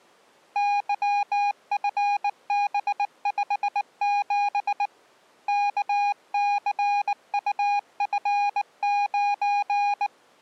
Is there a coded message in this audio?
Yes: Morse code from 0.5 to 10.1 s, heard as a keyed tone, hand-sent with a bug key, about 19 wpm, 820 Hz. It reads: YFB57 KCUF9